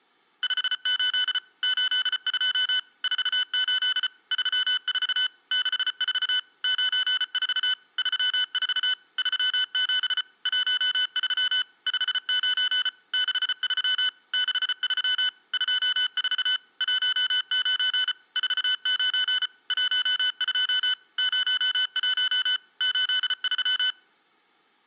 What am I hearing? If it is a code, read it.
Morse code, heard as electronic beeps, machine-sent, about 34 wpm, 1500 Hz. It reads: 58 82 48 34 64 94 34 37 13 59 63 63 24 19 49 12 01 83